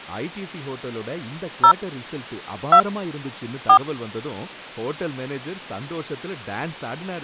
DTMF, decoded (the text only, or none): 0 2 4